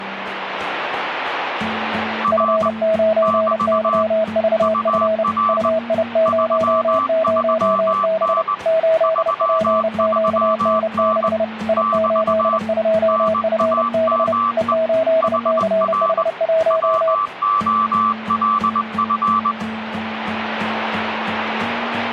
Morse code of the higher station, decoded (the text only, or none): R <BT> UR 33N 33N <BT> NAME HR WOLF